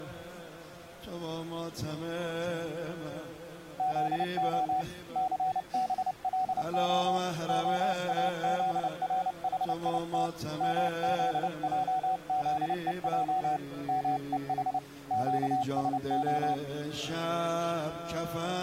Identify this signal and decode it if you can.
Morse code (Hebrew alphabet), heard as a keyed tone, hand-sent with a paddle, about 29 wpm, 750 Hz. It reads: זה סבלה האזרחית מזעזוע מוח קשה